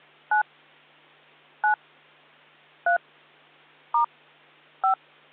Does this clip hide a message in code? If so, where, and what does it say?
Yes: DTMF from 0.3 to 4.9 s, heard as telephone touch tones, dialled by hand, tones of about 100 ms. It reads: 9 9 3 * 5